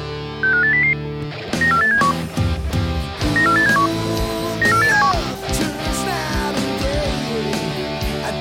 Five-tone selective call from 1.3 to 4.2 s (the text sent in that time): 94871 94871